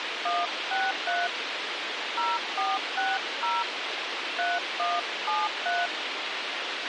DTMF, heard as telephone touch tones, dialled by hand, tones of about 200 ms, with radio hiss and a squelch burst at the end. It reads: 163 0460 3173